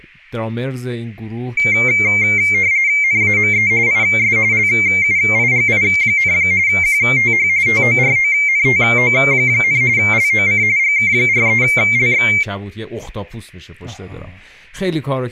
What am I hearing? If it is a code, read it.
RTTY (45.45 baud, 170 Hz shift), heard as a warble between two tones, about 2200 Hz centre, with speech in Persian. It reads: NAME IS LUIGI, QTH TORONTO, LOC GK43LX